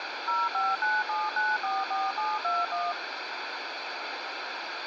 DTMF, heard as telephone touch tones, dialled by machine, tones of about 200 ms, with radio hiss and a squelch burst at the end. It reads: 0597944721